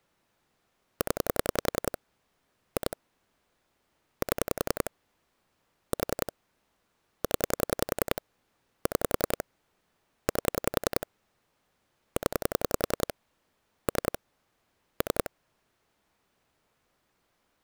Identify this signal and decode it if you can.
Pulse dialling, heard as clicks on a phone line, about 10 pulses a second. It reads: 0 2 7 4 0 6 8 0 3 3